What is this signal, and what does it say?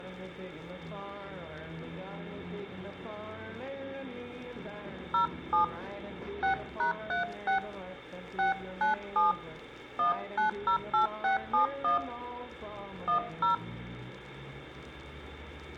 DTMF, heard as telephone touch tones, dialled by hand, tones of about 120 ms, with room echo. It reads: 07 6#36 697 1908671 10